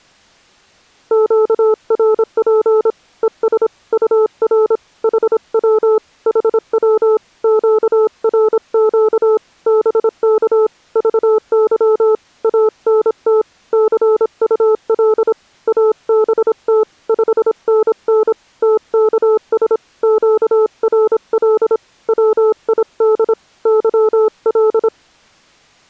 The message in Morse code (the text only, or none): QRP ES UR HW HW QRQ BK VY ANT CUL ABT 5NN TKS QRL WID YL